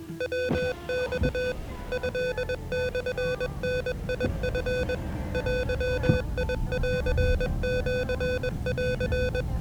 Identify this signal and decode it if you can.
Morse code (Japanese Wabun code), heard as electronic beeps, machine-sent, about 21 wpm, 500 Hz, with the noise inside a car. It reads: ヤマ トモダチ デンシン